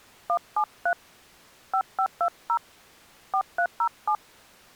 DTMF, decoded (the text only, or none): 173 5520 4307